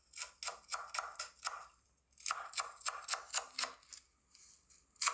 Kitchen noise. There is no code.